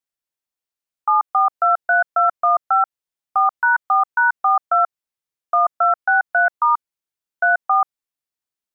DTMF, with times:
1.1-2.8 7423215
3.4-4.9 4#4#42
5.5-6.8 1263*
7.4-7.8 34

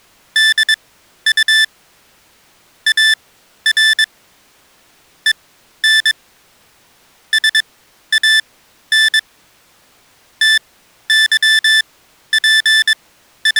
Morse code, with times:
0.4-1.6 DU
2.9-4.0 AR
5.3-6.1 EN
7.3-9.2 SAN
10.4-13.6 …

